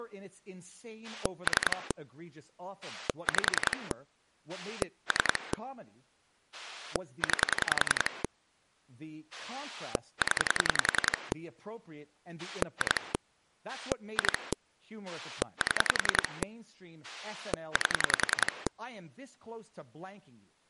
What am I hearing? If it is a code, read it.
Pulse dialling, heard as a rotary dial, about 10 pulses a second, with speech in English. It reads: 3 5 3 9 0 2 2 7 8